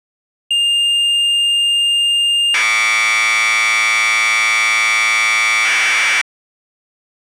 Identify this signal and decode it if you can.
Commodore tape loading (standard loader), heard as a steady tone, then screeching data.